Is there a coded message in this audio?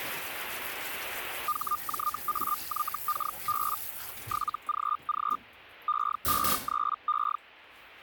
Yes: Hellschreiber (Feld-Hell, 122.5 baud) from 1.5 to 7.4 s, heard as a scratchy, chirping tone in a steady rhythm, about 1210 Hz, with kitchen noise. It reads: HJAYKB 7GG E53E